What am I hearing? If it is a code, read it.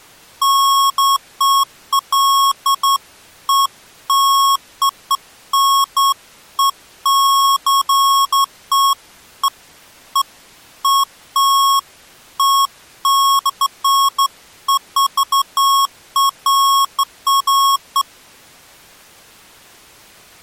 Beeps of irregular length. There is no code.